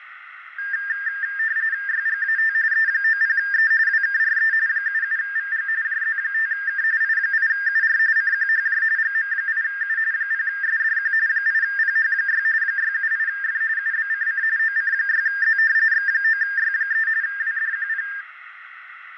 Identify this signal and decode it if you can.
RTTY (45.45 baud, 170 Hz shift), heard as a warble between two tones, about 1700 Hz centre, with radio static. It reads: YGAT E90E WKRE 77VG JZ5K I8UR CQHJ GM8U 0SDQ 8PH6 678F UBCC OC6Z X9Y3 WDQP